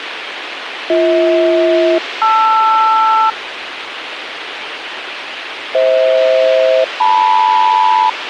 Aircraft SELCAL, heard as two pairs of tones, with radio hiss. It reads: BH-LR FH-LM